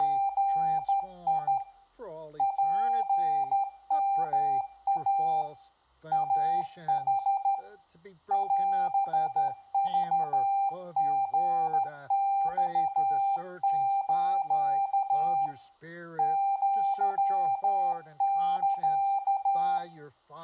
Morse code (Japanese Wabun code), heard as a keyed tone, hand-sent with a straight key, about 13 wpm, 790 Hz, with room echo. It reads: … ツヨイ イヌ オクリマス アサ